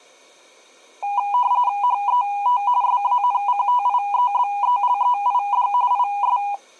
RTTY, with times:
1.8-2.6 HET
2.8-5.7 SANCTIEBELEID
5.9-6.4 IS

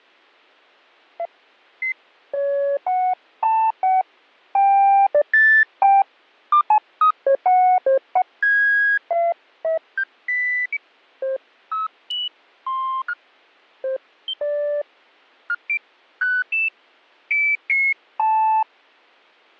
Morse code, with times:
none

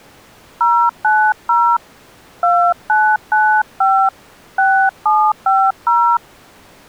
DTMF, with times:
0.6-1.8 090
2.4-4.1 2995
4.6-6.2 6750

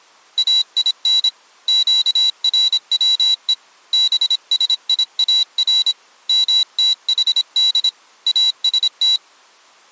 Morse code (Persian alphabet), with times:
0.4-1.3 این
1.7-3.5 گروه
3.9-5.9 بسیار
6.3-7.9 متحد
8.3-9.2 است

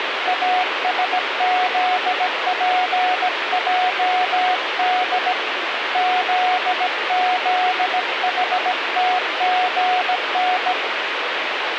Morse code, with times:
0.3-5.3 ASZPJD
6.0-10.7 ZZHTGN

